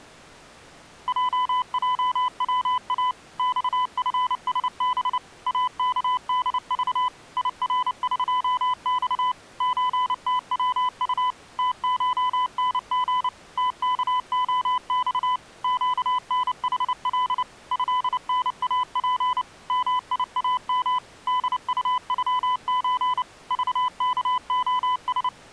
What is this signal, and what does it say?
Morse code (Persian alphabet), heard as a keyed tone, machine-sent, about 29 wpm, 1000 Hz. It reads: ججوا خفسب اکدذ یرقخ چتوط تشنژ تکعخ گنحل ضناپ میام دطغچ ذکعس